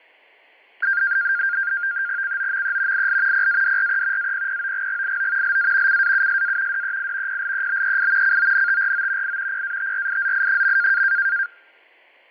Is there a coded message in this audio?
Yes: NAVTEX (SITOR-B), 100 baud, 170 Hz shift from 0.8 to 11.5 s, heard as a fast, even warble, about 1500 Hz centre, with fading and static crashes. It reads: COME IL PADRE APPOGGIO LA CAUSA DEI PLEBEI CONTRO I PATRIZI.